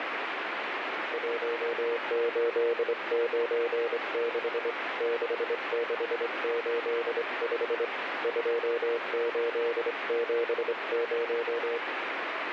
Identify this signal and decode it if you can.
Morse code, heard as a keyed tone, hand-sent with a straight key, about 24 wpm, 470 Hz, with radio static. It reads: 1896 6685 2870